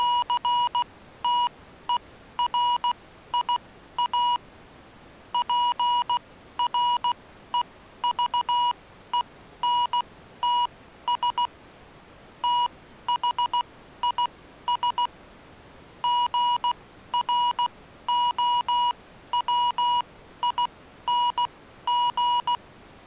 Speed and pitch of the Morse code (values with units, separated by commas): 16 wpm, spaced as for 12 wpm, 970 Hz